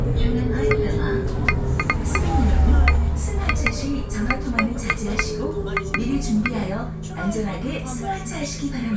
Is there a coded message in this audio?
No, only irregular taps on glass, with the noise inside a bus.